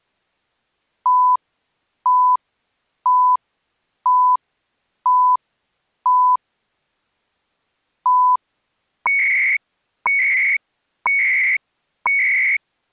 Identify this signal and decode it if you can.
Radio time signal (CHU, Canada), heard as beeps and data bursts, one a second.